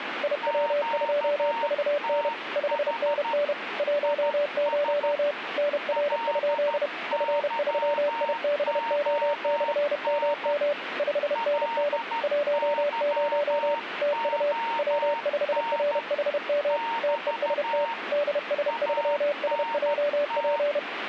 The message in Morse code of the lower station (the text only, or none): IW2VN 5NN 10 NR? F3IBO/MM 5NN 10 TU W5RHM TEST DS3SJP